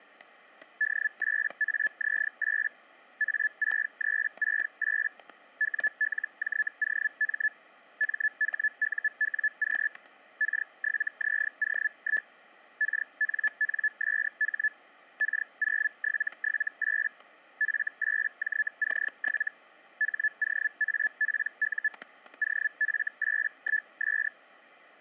Hellschreiber (Feld-Hell, 122.5 baud), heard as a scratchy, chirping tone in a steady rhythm, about 1750 Hz, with static crashes. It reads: D8AZ8 A6368 WLJOM MHUWQ K7ZO1 KNNSH K0778 F8JC7 HOAPU OF81S